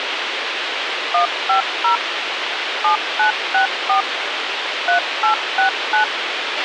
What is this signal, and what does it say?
DTMF, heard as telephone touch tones, dialled by machine, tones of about 110 ms, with radio hiss and a squelch burst at the end. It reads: 150 7964 3869